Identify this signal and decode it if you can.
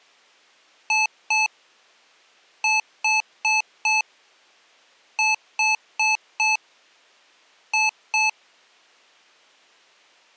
Beep code, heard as beeps from a small speaker, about 870 Hz. 2-4-4-2.